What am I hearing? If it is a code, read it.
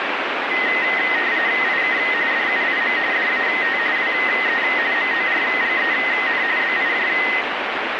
RTTY (45.45 baud, 170 Hz shift), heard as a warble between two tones, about 1950 Hz centre, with radio static. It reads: IK DUIM DAT WE MORGEN BIJ